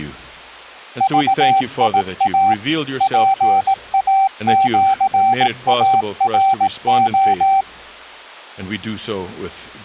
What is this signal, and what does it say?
Morse code (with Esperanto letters), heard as a keyed tone, machine-sent, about 18 wpm, 780 Hz, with speech in English. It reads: VIA PAĜARO